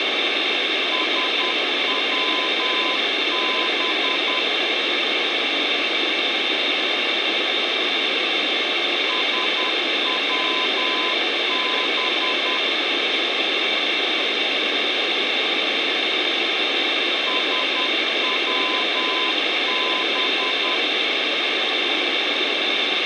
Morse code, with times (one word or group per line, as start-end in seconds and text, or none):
0.9-4.4 SWB
9.1-12.6 SWB
17.3-20.8 SWB